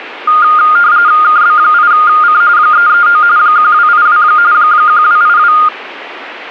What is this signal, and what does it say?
RTTY (45.45 baud, 170 Hz shift), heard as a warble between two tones, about 1320 Hz centre. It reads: KB8C 339 1282 1282